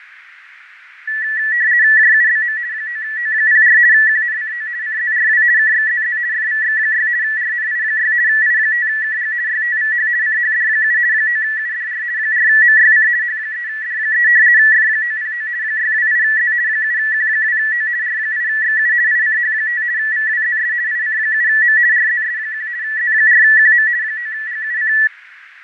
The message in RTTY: JUBM 9O04 QNCO CZRW KXZZ FVX6 RNI6 I5KG YTVH CHD7 9UDR 4MYC H3D3 F909 628Z 7Q2O R8XU ICH5 VWZS IC7M RZS1 Z4QM 9GUC

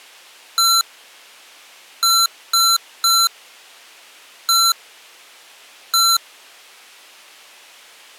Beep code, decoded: 1-3-1-1

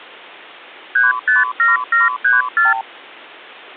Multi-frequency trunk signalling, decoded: 357734

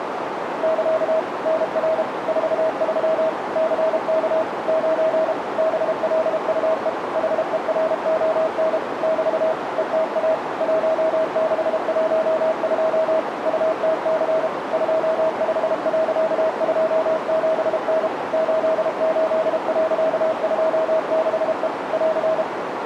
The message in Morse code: <KA> NR 43 CK 9 BLUE HERON <BT> ETA 1612 UTC 25.27N 88.26E <AR>

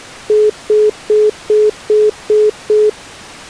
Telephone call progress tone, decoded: congestion tone

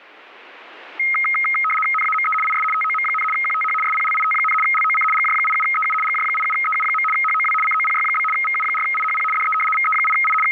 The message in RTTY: NAME IS TOM, QTH SPLIT, LOC GJ87EU GJ87EU. HOW COPY? VU4IHP DE VE8I …

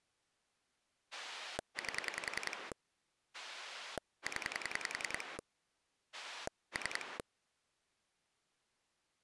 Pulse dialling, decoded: 8 0 3

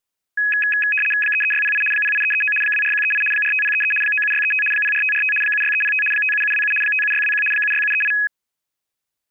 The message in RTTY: 33608 08339 24138 45033 97635 04545 76305 57727 57621 76738

